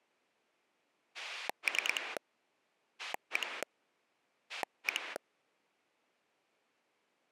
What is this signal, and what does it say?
Pulse dialling, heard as a rotary dial, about 9 pulses a second. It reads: 3 1 1